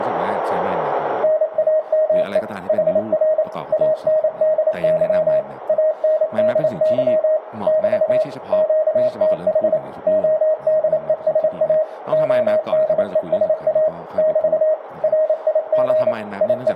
Morse code, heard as a keyed tone, machine-sent, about 28 wpm, 620 Hz, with room echo and speech in Thai. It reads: NAME HR ANDY ANDY <BT> QTH ODESA ODESA <BT> RIG …